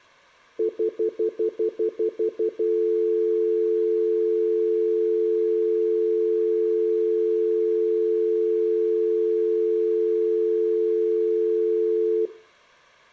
Telephone call progress tone (North American plan), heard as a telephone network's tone, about 350, 440 Hz, 0.1 s on and 0.1 s off, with room echo. Stutter dial tone.